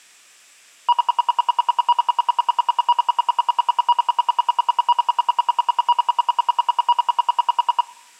Radio time signal (RWM, Moscow), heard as ten pulses a second, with room echo.